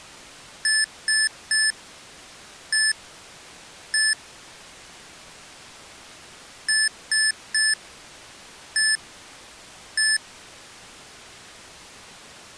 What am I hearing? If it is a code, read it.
Beep code, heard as beeps from a small speaker, played twice, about 1750 Hz. 3-1-1. In Phoenix BIOS tables: DMA register failure.